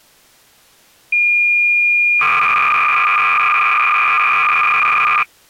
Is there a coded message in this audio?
Yes: cassette data (Kansas City type), 300 baud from 1.1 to 5.2 s, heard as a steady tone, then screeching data.